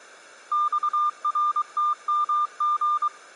Morse code, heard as a keyed tone, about 23 wpm, 1200 Hz. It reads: XRTMG